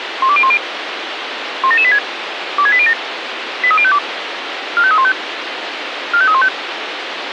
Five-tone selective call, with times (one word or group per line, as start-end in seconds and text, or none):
0.2-0.6 12010
1.6-2.0 17786
2.6-2.9 26807
3.6-4.0 83052
4.8-5.1 45315
6.1-6.5 45315